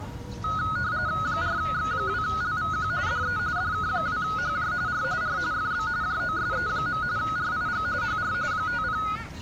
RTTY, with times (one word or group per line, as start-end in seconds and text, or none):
1.2-2.9 4X2LVQ
3.1-3.4 DE
3.6-4.7 DK2HJ
4.9-5.0 R
5.2-5.4 R
5.5-5.9 FB
6.0-7.0 JOSE.
7.2-7.9 RIG
8.0-8.3 HR
8.5-9.0 50